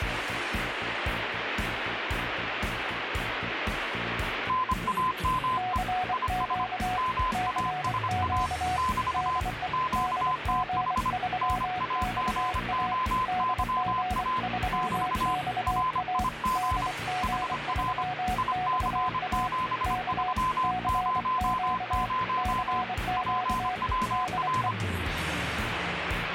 Morse code, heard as two keyed tones, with radio static. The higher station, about 25 wpm, 1020 Hz: NAME IS MASA <BT> QTH NAGOYA <BT> RIG HR IC7300 PWR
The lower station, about 24 wpm, 740 Hz: CQ CQ DE DG3XA DG3XA DG3XA K CQ CQ DE